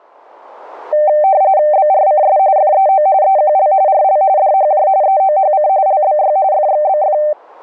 RTTY (45.45 baud, 170 Hz shift), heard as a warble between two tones, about 690 Hz centre. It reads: BRCS FEO EQL RL DHJ EOHC LBY FXBF